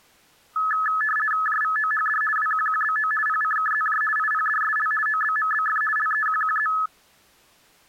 RTTY (50 baud, 450 Hz shift), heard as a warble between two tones, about 1500 Hz centre. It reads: JVOHD WQQBO PCKZJ IPDSL OBMBF LEQQZ